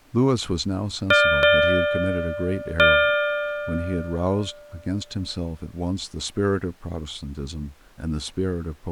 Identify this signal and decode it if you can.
Ship's bell, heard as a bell, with speech in English. 3. Three half-hours of the watch have passed.